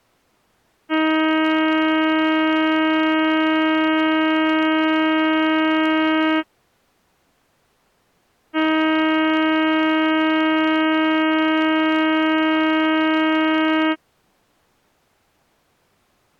Ship horn signal, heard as a ship's horn, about 320 Hz. 2 long. At sea: a vessel under power that has stopped in fog.